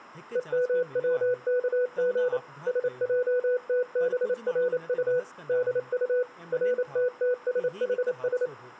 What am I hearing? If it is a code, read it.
Morse code (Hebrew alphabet), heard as a keyed tone, machine-sent, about 28 wpm, 500 Hz, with speech in Sindhi. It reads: ומצכג שעתברט דט רתתשחש